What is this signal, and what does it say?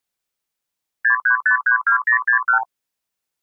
Multi-frequency trunk signalling (R2, with the far end's replies), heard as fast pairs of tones, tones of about 100 ms. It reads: 63532061